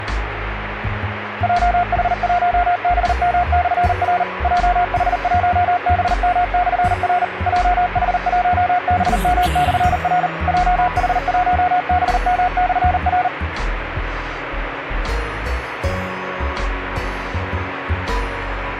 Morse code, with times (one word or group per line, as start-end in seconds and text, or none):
1.4-4.2 JH1BM/R
4.4-7.2 JH1BM/R
7.5-10.3 JH1BM/R
10.5-13.3 JH1BM/R